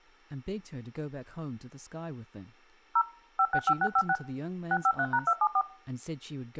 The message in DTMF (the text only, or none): 0 565656 653#274